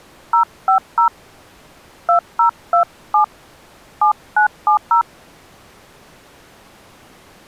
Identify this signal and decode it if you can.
DTMF, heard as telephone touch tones, dialled by hand, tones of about 100 ms. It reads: 050 2027 7970